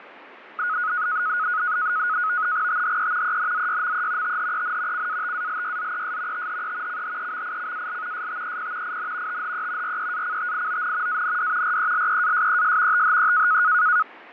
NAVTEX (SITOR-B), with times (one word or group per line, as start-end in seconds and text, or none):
2.7-3.4 THE
3.2-4.4 ENZYME
4.2-5.1 THEN
4.9-6.5 CATALYZES
6.3-7.0 THE
6.9-8.3 CHEMICAL
8.1-9.0 STEP
8.8-9.4 IN
9.3-10.0 THE
9.8-11.2 REACTION
11.1-11.8 AND
11.6-13.0 RELEASES
12.9-13.6 THE